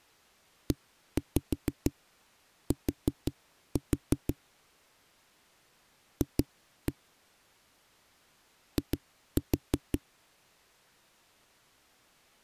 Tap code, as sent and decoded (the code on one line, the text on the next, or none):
1-5 4-4 / 2-1 / 2-4
ET F I